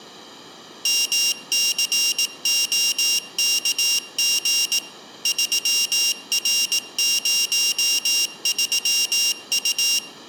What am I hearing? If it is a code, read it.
Morse code, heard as a high beeper, machine-sent, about 18 wpm, 2800 Hz, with room echo. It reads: MCOKG 3R03U